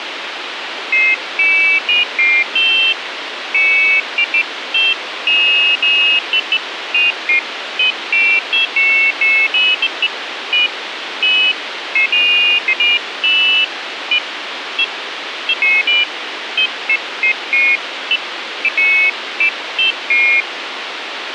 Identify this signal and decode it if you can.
Pairs of high tones at irregular times, with radio hiss. There is no code.